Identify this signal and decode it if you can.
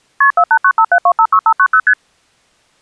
Multi-frequency trunk signalling (R1, as on North American trunks), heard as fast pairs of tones, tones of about 70 ms. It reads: KP 48957256590 ST